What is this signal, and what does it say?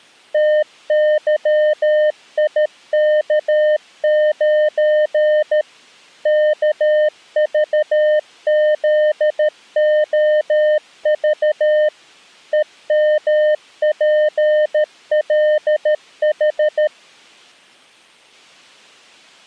Morse code, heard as a keyed tone, machine-sent, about 13 wpm, 610 Hz. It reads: TYIK9 KVZOV EMPLH